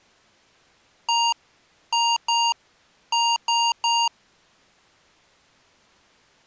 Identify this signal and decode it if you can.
Beep code, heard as beeps from a small speaker, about 940 Hz. 1-2-3. In Phoenix BIOS tables: DMA page register failure.